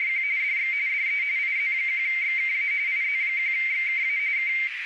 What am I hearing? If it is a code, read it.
RTTY (45.45 baud, 170 Hz shift), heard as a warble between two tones, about 2200 Hz centre, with radio static and a narrow filter. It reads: … DX DE IZ1XKA IZ1XKA K